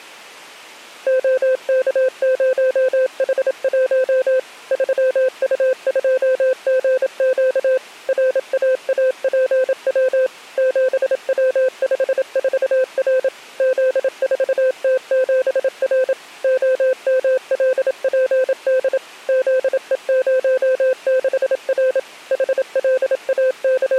Morse code, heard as a keyed tone, machine-sent, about 27 wpm, 520 Hz. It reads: OK0H1 3U2GQ RAAPW 7W54R Z4T7R OMLPD ZE06R …